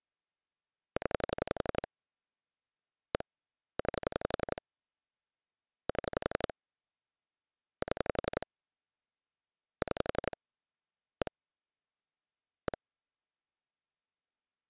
Pulse dialling, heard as clicks on a phone line, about 11 pulses a second. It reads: 0 1 9 7 7 6 1 1